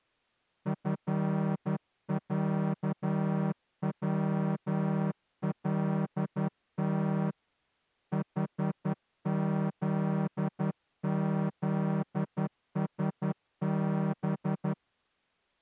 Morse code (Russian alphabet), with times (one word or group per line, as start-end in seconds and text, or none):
0.7-7.3 ФЯВЛТ
8.1-14.7 ХЗЗСБ